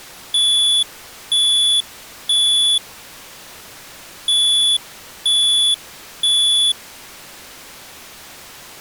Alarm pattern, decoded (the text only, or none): temporal three